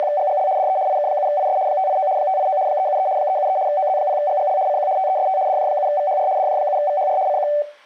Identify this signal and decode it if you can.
RTTY (75 baud, 170 Hz shift), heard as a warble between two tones, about 670 Hz centre. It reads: … DE IK7IS 589 589 373 373 OZ0GGL CQ TEST DJ7VHR DJ7VHR CQ